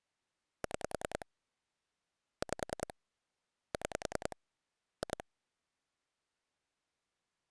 Pulse dialling, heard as clicks on a phone line, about 10 pulses a second. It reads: 6 5 6 2